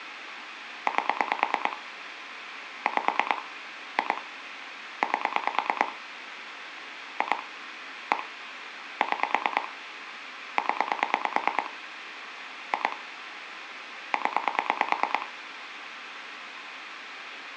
Pulse dialling, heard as clicks on a phone line, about 9 pulses a second, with phone line noise. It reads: 8 5 2 8 2 1 6 0 2 0